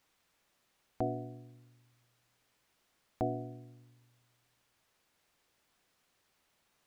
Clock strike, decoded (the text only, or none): 2